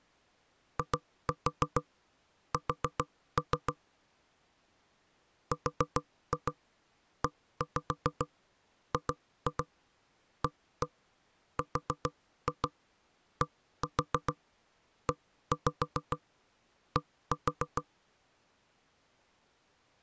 Tap code, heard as knocks on wood, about 7 knocks a second. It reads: IS REGARDED